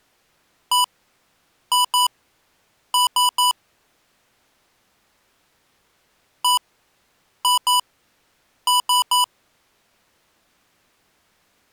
Beep code, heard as beeps from a small speaker, played twice, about 990 Hz. 1-2-3. In Phoenix BIOS tables: DMA page register failure.